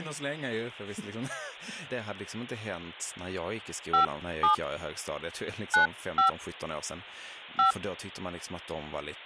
DTMF, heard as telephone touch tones, dialled by hand, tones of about 120 ms, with speech in Swedish. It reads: 57 95 5